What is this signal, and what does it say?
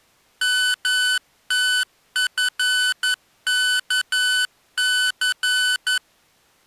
Morse code, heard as electronic beeps, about 11 wpm, 1500 Hz. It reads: MTFKC